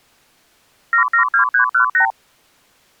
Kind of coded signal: multi-frequency trunk signalling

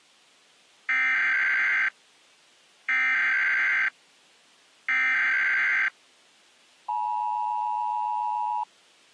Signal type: Emergency Alert System (SAME) tones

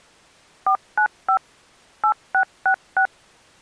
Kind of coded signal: DTMF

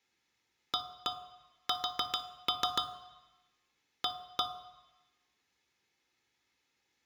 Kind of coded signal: tap code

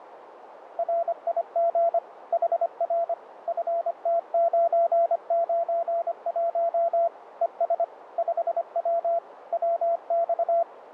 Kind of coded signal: Morse code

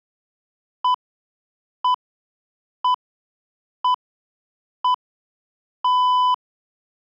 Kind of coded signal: radio time signal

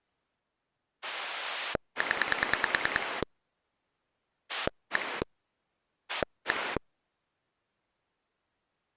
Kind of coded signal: pulse dialling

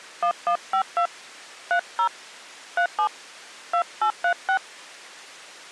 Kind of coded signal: DTMF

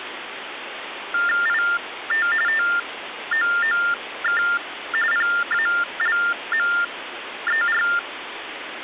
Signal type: TTY/TDD text telephone tones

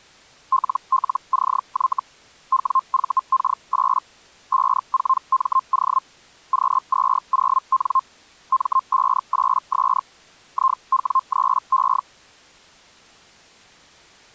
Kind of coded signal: Hellschreiber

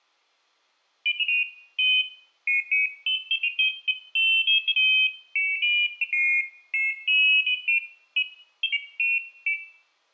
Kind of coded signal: none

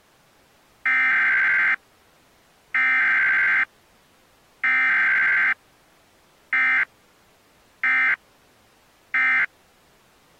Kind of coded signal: Emergency Alert System (SAME) tones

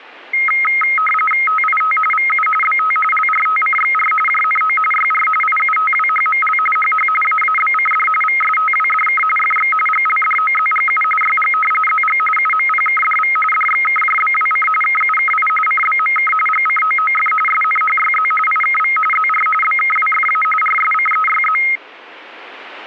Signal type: RTTY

